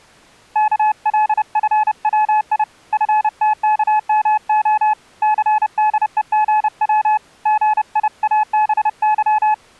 Morse code (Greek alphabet), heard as a keyed tone, hand-sent with a paddle, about 30 wpm, 860 Hz. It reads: ΚΛΦΩΙ ΦΤΚΜΟ ΘΔΕΓΩ ΓΙΑΒΥ